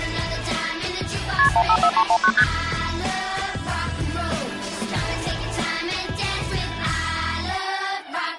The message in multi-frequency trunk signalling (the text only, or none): KP 154319 ST